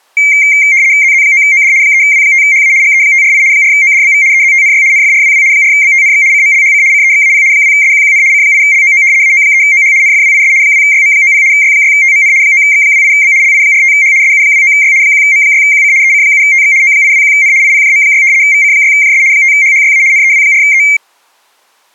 RTTY (75 baud, 170 Hz shift), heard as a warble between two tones, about 2200 Hz centre. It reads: ZZ9OD 3W5HA GE548 4ODBV EZTNY NFRWW 4BTNX CMLHC CEXAP 2SQQN C8LOO AO3OH NFWIS 2YM90 Y6TMN 9X28B LI45H SU29Y 1M6QC EC7TX O821N IPJM6 VC6JS 5HHYA NEW4E